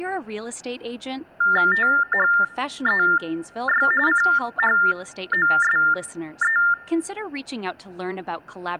TTY/TDD text telephone tones (45.45 baud Baudot), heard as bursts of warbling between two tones, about 400 Hz shift, 1600 Hz centre, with speech in English. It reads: THEY CHOSE